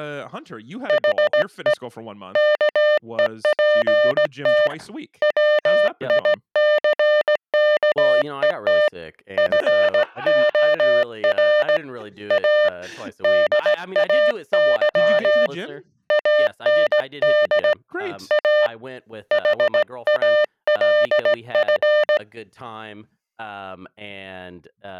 Morse code, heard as a keyed tone, hand-sent with a straight key, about 17 wpm, 600 Hz, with speech in English. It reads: HE KEPT WICKET FOR A DAY AND A HALF